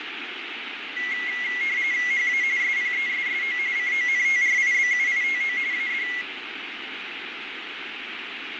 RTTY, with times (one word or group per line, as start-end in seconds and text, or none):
2.1-2.4 HA
2.6-3.6 SPESSO
3.8-5.6 CONTRIBUITO
5.7-6.1 AD